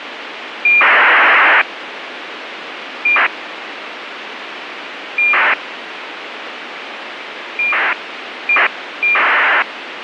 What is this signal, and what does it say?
ACARS aircraft data, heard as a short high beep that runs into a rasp, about 2400 baud, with radio hiss.